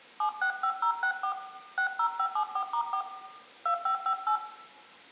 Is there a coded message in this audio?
Yes: DTMF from 0.2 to 4.4 s, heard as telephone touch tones, dialled by hand, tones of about 90 ms, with room echo. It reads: 765064 60574*4 2558